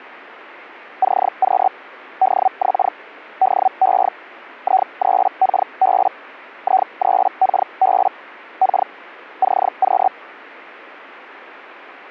Hellschreiber (Feld-Hell, 122.5 baud), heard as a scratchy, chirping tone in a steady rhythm, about 760 Hz. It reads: CQ DX DE I3KB I3KB K CQ